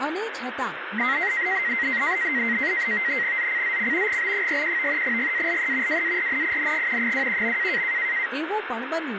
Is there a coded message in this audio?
Yes: NAVTEX (SITOR-B), 100 baud, 170 Hz shift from 1.0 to 8.3 s, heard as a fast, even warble, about 2000 Hz centre, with radio static and speech in Gujarati. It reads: ZCZC GB41 GALE WARNING 21.